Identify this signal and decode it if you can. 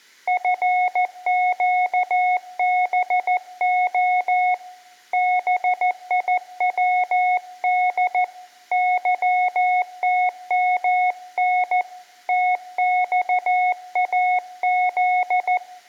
Morse code (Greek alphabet), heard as a keyed tone, hand-sent with a paddle, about 14 wpm, 730 Hz, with room echo. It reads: ΦΨΒΟ ΒΙΩΔ ΥΤΜΝ ΤΞΑΖ